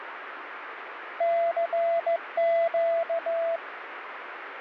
Morse code, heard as a keyed tone, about 15 wpm, 670 Hz, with radio static. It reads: CQ